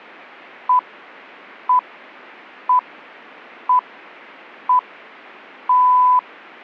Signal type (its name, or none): radio time signal